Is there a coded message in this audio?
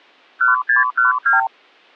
Yes: multi-frequency trunk signalling (R2, with the far end's replies) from 0.4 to 1.5 s, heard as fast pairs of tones, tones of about 140 ms. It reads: 1612